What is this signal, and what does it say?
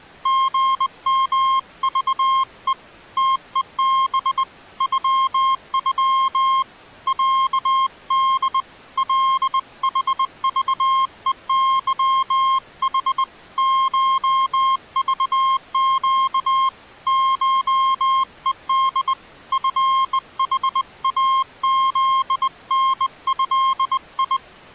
Morse code (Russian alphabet), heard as a keyed tone, hand-sent with a bug key, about 20 wpm, 1060 Hz. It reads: ГМЖЕ ТЕБ ЮЮ ЯД ЛХЖЕЫХ ШЖЩ ШЕД ФХАЗНЭИ